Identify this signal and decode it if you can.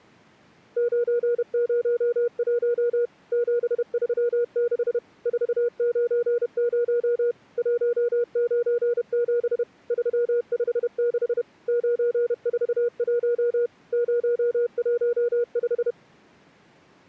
Morse code, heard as a keyed tone, machine-sent, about 31 wpm, 480 Hz. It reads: 901 736 490 197 356 941 015